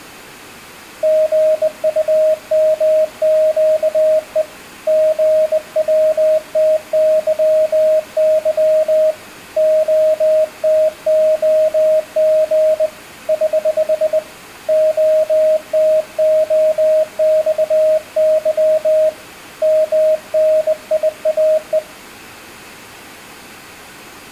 Morse code, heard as a keyed tone, hand-sent with a bug key, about 20 wpm, 620 Hz, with room echo. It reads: GUMQE GWTYY OTOG <HH> OTOXY MNIAE